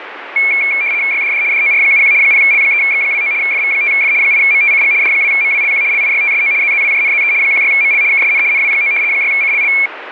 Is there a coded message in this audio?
Yes: RTTY (75 baud, 170 Hz shift) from 0.4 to 9.9 s, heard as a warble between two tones, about 2300 Hz centre, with radio static. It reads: YDD DOR71 0L3X29 FV5F 8MTCG D2MWLQ LIYTSO ZZWJNZE 16ML KSN NW9 6CLL